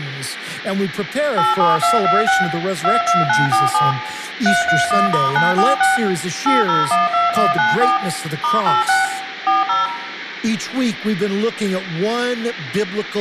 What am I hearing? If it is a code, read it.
DTMF, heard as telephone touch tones, dialled by machine, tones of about 170 ms, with room echo. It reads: 87226 22947 331*946 8012194 *86 40